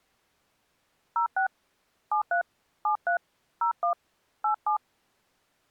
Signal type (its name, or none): DTMF